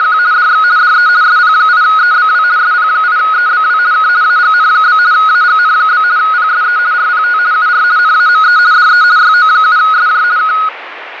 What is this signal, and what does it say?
RTTY (50 baud, 170 Hz shift), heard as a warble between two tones, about 1360 Hz centre, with radio static. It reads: … DX DE SP8EBW SP8EBW K AGN? AGN? PSE RPT UR NAME DE YO7SJ K